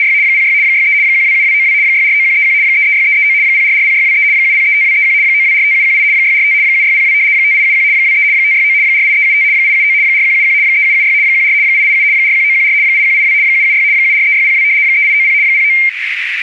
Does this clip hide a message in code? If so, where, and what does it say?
Yes: RTTY (75 baud, 170 Hz shift) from 0.0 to 15.9 s, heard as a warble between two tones, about 2200 Hz centre, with radio static and a narrow filter. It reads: … 06 63 127292 649131 336339 0440623 7035231 9245718 645 7602 5871 23 569 48375 879 4171 3776 14 887 41914 8182 776 743602 3890 09